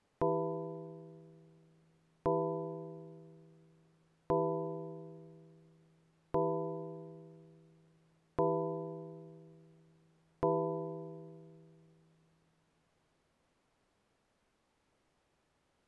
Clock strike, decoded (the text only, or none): 6